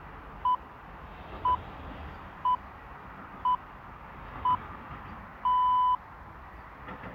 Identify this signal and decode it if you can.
Radio time signal (six pips, as the Greenwich Time Signal), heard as pips, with the noise of a residential street.